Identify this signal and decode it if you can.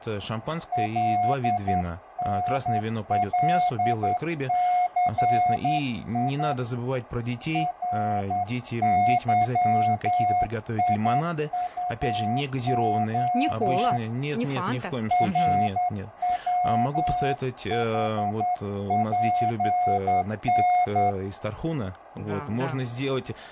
Morse code, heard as a keyed tone, hand-sent with a straight key, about 10 wpm, 720 Hz, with radio static, fading, a narrow filter and speech in Russian. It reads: LNLCI RYIUO RWHPN